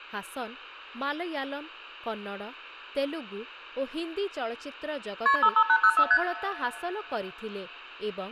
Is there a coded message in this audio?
Yes: multi-frequency trunk signalling (R1, as on North American trunks) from 5.3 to 6.2 s, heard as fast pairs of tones, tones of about 70 ms, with room echo and speech in Odia. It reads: KP 55804 ST